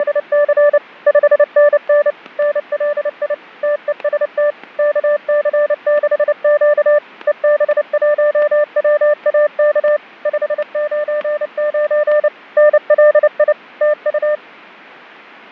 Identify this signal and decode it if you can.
Morse code, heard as a keyed tone, machine-sent, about 29 wpm, 590 Hz, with fading and static crashes. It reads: … 5NN NLI TEST KC6Q EB1WAK 599 NLI TU